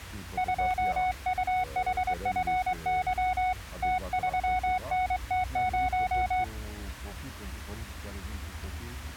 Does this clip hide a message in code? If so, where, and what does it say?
Yes: Morse code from 0.3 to 6.5 s, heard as a keyed tone, hand-sent with a straight key, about 22 wpm, 740 Hz. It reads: 2UHFY T3NT0